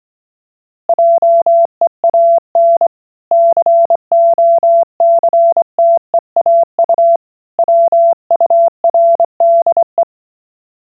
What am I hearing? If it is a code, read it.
Morse code, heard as a keyed tone, hand-sent with a straight key, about 24 wpm, 680 Hz. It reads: JEAN COCTEAU WURDE